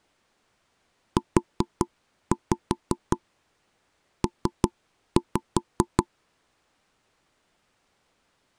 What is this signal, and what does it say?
Tap code, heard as knocks on wood, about 5 knocks a second. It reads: UP